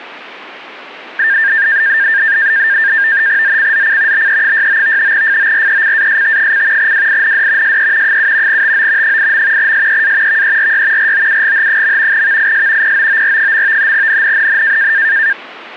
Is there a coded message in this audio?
Yes: NAVTEX (SITOR-B), 100 baud, 170 Hz shift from 1.2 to 15.3 s, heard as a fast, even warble, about 1700 Hz centre. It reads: ZCZC BE69 FORECAST: WIND SE 7 TO 8. SEA VERY ROUGH. VIS POOR. NNNN